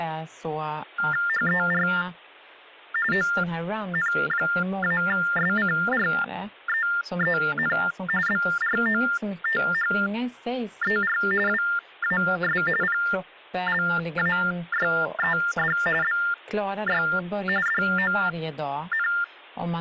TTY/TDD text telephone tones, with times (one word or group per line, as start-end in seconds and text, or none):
1.3-1.9 HER
3.1-7.8 ON-SCREEN
8.3-11.2 BROTHER
11.5-12.6 WAS
12.8-15.8 PLAYED
16.0-17.0 BY
17.7-19.1 DON